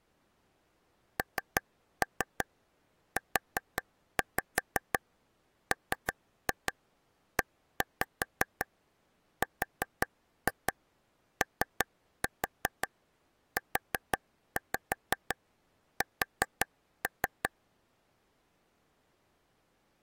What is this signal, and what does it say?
Tap code, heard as taps on a table, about 5 knocks a second. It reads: NUMEROUS